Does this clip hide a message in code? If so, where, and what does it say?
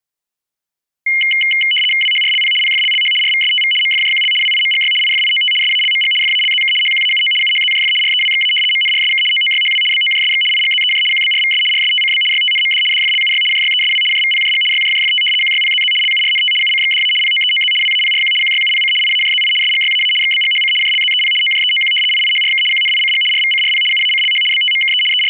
Yes: RTTY (75 baud, 850 Hz shift) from 1.1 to 25.3 s, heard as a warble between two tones, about 2550 Hz centre. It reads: WHRLP PFLLH RVSTV MFJQL WIMGY IFIOT SALMG FALZK HQAUO UHZJF REWXA MNRSK OOYHW BOJSX IGZEJ QBRVS RSTCB YTNMD DFLUY JYESW JVPJG YJJFT QYPZZ LURNT UCXDA POEOZ WAPRQ QYUPC IAJZI SGYAA XBGHC JLZEP OJEOQ IIHRK QNICG RVCRP UACLH BTMKE …